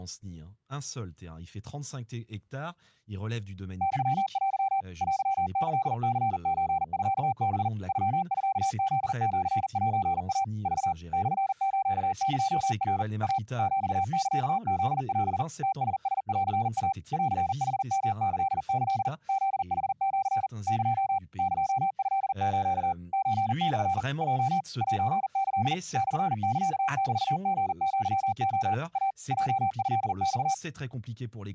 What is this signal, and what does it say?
Morse code (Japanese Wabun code), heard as a keyed tone, machine-sent, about 40 wpm, 780 Hz, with speech in French. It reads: ユテ テキニソミハ ノミフシセイ ク モスエナ イ ヒサフオ ムラランイ ンヌヨキキ フヌシ エ エトス ソモ ヲ セキ モサメリアレ イ ヲトマ